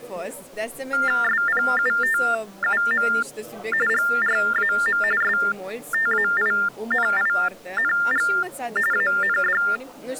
TTY/TDD text telephone tones (45.45 baud Baudot), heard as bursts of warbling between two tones, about 400 Hz shift, 1600 Hz centre. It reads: SPUTUM GRAM STAINING AND